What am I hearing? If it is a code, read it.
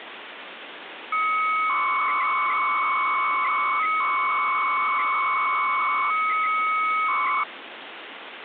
300-baud modem data (Bell 103 tones), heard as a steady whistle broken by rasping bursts, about 300 baud, 200 Hz shift, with phone line noise.